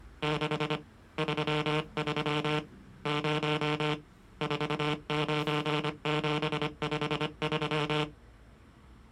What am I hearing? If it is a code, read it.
Morse code, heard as a buzzer, hand-sent with a paddle, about 25 wpm, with street noise. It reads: 6 33 0 49753